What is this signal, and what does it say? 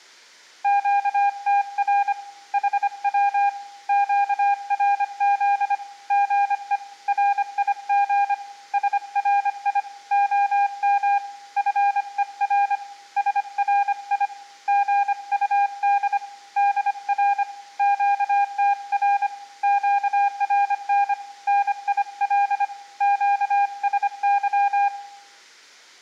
Morse code, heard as a keyed tone, hand-sent with a paddle, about 25 wpm, 810 Hz, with room echo. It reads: QTR HW QRZ GE RIG SRI OM FER SRI GUD DR QTR QRN NIL QSY